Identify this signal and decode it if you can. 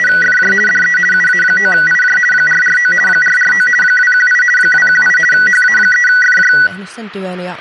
RTTY (50 baud, 450 Hz shift), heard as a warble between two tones, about 1700 Hz centre, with speech in Finnish. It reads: … DE UA9IJ 449 449 218 218 HA3FJ